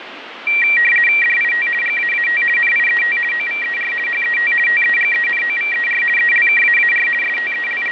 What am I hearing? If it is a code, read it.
RTTY (50 baud, 450 Hz shift), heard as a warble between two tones, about 2100 Hz centre, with radio static. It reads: DIT GAAT NIET OVER HET TEGENOVER ELKAAR …